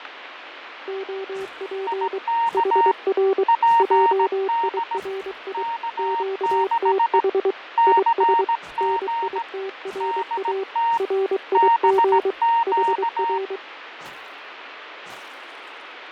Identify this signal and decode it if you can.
Morse code, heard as two keyed tones, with radio static and fading. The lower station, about 23 wpm, 390 Hz: OP HR JIRI QTH IS NITRA RIG HR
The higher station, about 17 wpm, 930 Hz: IK PD K6 CG DT BQ